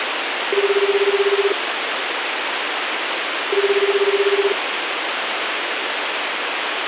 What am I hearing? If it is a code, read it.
Telephone call progress tone (Japanese plan), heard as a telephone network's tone, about 380, 400, 420 Hz, 1 s on and 2 s off, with phone line noise. Ringback tone.